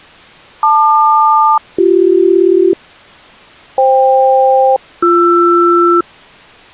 Aircraft SELCAL, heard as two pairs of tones. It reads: LQ-BC FK-BR